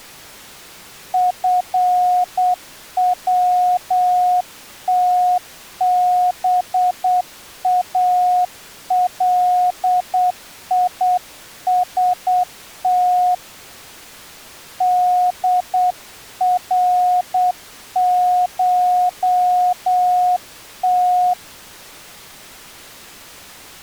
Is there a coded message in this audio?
Yes: Morse code (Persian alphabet) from 1.1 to 21.4 s, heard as a keyed tone, hand-sent with a paddle, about 8 wpm, 720 Hz. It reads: فوتبالیست درشت